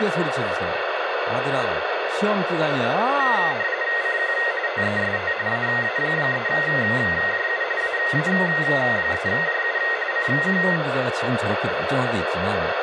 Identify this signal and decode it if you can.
RTTY (45.45 baud, 170 Hz shift), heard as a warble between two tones, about 1950 Hz centre, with radio static and speech in Korean. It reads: CQ TEST AA3JU AA3JU CQ